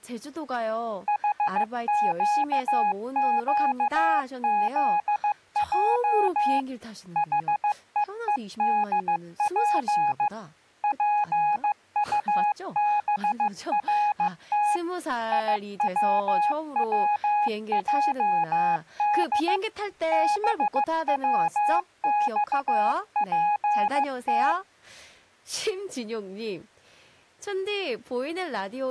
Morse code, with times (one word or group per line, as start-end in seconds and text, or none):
1.1-6.6 HQQZJ
7.2-10.3 HEEDP
10.8-14.8 PUBRT
15.3-19.6 IWWJD
20.1-24.5 BWXPT